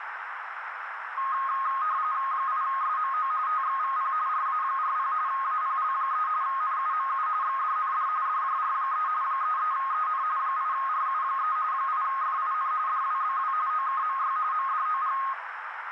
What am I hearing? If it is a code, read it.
RTTY (45.45 baud, 170 Hz shift), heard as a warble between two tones, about 1160 Hz centre, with radio static and a narrow filter. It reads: 8SMO TXVP RA40 APL3 NUMU XDND DJR3 33EN 8RU3 8FIN DWBW OKMY MDOG